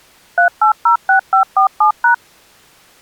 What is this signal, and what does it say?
DTMF, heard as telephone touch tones, dialled by machine, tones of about 110 ms. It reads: 3806547#